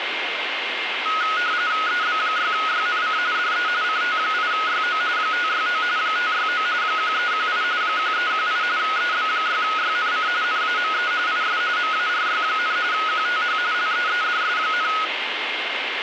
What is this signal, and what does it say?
RTTY (45.45 baud, 170 Hz shift), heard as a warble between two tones, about 1360 Hz centre, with radio static and a steady whistle near 2120 Hz. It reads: EB6YNC DE CT8YO 569 569 1318 1318 EB6YNC NAME IS MARY, QTH LEEDS,